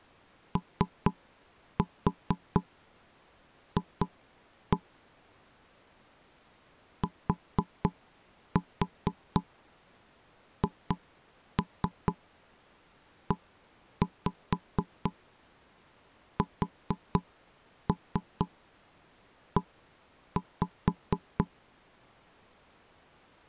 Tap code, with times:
0.6-4.8 OF
7.0-21.4 THESE

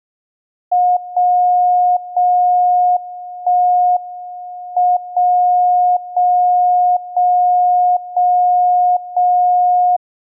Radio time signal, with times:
1.0-2.0 0
2.0-3.0 0
3.0-4.0 1
4.0-5.0 M
5.0-6.0 0
6.0-7.0 0
7.0-8.0 0
8.0-9.0 0
9.0-10.0 0

